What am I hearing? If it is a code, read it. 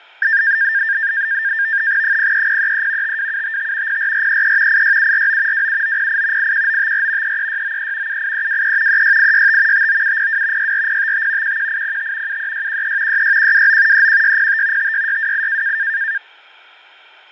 NAVTEX (SITOR-B), 100 baud, 170 Hz shift, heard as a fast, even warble, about 1700 Hz centre, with fading. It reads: 03033 52755 04433 86749 27908 81954 33693 78323 36865 59702 64055 11805 73613 66129 31605 56628